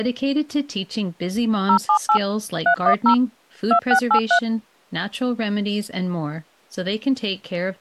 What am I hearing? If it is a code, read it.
DTMF, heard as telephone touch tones, dialled by machine, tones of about 90 ms, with speech in English. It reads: 078 310 2683